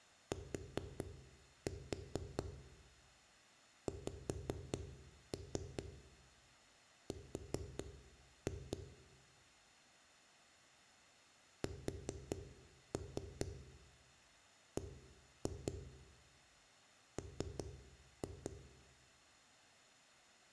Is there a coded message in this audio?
Yes: tap code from 0.3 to 18.5 s, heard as knocks on a wall, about 4 knocks a second, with room echo. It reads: TXR SBM